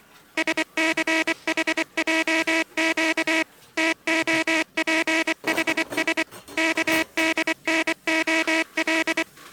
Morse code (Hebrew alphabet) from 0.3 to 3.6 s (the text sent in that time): שסחעק